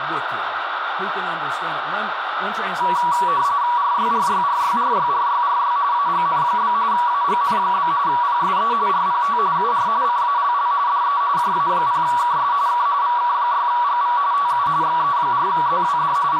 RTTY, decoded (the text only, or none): RYRYRYRYRYRY AGN? AGN? PSE RPT UR CALL DE JA0KS K VK6GV TU XE4ZWD …